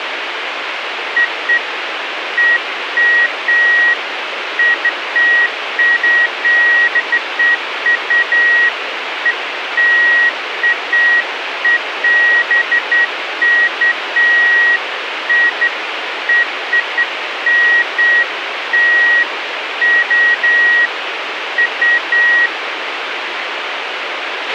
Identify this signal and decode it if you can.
Beeps of irregular length, with radio hiss and a squelch burst at the end. There is no code.